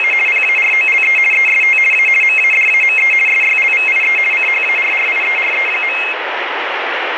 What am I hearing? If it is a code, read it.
RTTY (50 baud, 450 Hz shift), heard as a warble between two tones, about 2350 Hz centre, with radio static. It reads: … PAROLE EST A MADAME SYLVIE CHARRIERE.